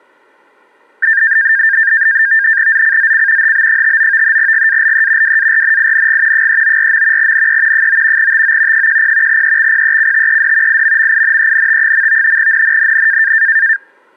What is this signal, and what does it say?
NAVTEX (SITOR-B), 100 baud, 170 Hz shift, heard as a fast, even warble, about 1700 Hz centre. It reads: ZCZC HB59 GALE WARNING 394. NE 9 TO 10 EXPECTED IMMINENT. NNNN